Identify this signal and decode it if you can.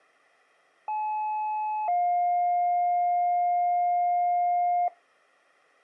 Two-tone page, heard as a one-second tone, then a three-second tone, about 860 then 710 Hz.